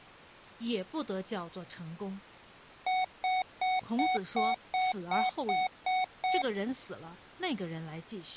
Beep code, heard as beeps from a small speaker, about 740 Hz, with speech in Chinese. 10 short. In AMI BIOS tables: CMOS shutdown register error.